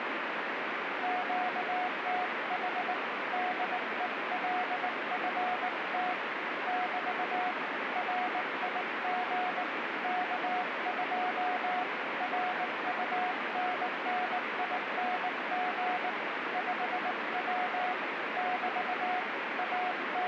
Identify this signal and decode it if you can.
Morse code, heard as a keyed tone, hand-sent with a paddle, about 19 wpm, 730 Hz, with heavy radio static. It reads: QTH DELFT <BT> RIG K2 RUNNING 5W <BT> …